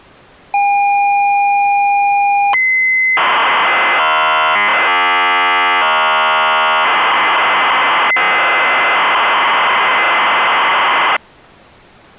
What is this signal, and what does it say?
ZX Spectrum tape loading, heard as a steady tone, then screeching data.